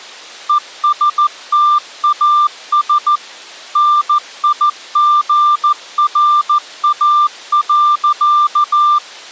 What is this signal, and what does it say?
Morse code, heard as a keyed tone, machine-sent, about 14 wpm, 1190 Hz. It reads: ESTAS NIGRA.